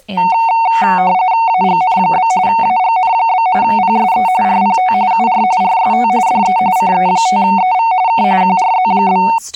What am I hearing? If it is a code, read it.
RTTY (45.45 baud, 170 Hz shift), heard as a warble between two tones, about 830 Hz centre, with speech in English. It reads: AGN? AGN? PSE RPT UR RST DE CE5EV K QRZ?